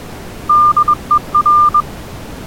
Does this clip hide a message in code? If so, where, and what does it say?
Yes: Morse code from 0.4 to 1.9 s, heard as a keyed tone, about 21 wpm, 1200 Hz. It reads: DER